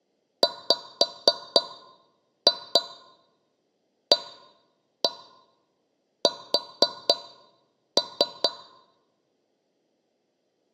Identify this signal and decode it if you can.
Tap code, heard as taps on a metal pipe, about 4 knocks a second. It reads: WAS